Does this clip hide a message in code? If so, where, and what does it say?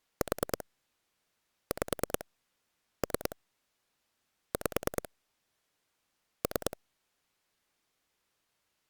Yes: pulse dialling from 0.2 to 6.7 s, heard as clicks on a phone line, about 9 pulses a second. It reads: 4 5 3 5 3